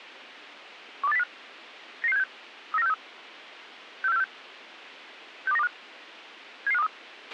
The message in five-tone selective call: 12805 99676 39463 64646 62925 77523

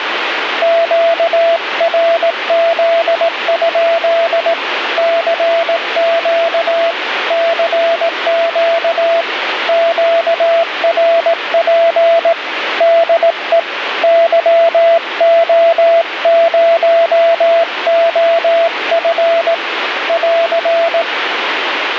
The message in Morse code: QRZ? CQ CQ QRP DE YO0OF <AR>

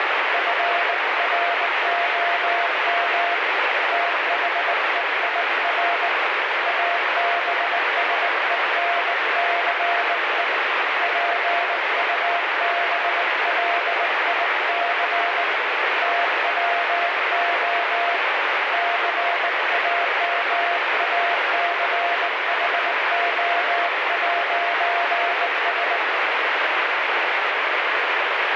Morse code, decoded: FROM THEIR ABSENCE PUBLIC TWO CAMACHO'S

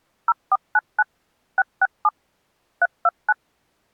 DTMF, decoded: 0499 667 329

